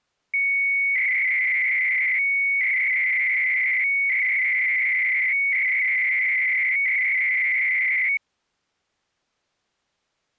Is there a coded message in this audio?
Yes: 300-baud modem data (Bell 103 tones) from 0.3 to 8.2 s, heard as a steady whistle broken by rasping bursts, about 300 baud, 200 Hz shift.